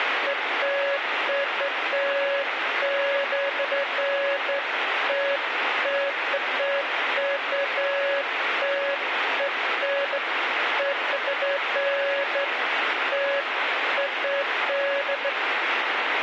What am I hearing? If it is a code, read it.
Beeps of irregular length, with radio static. There is no code.